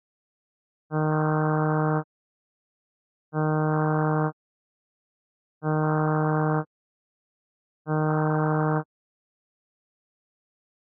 Ship horn signal, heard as a ship's horn, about 150 Hz. 4 short. At sea: a pilot vessel's identity signal in fog.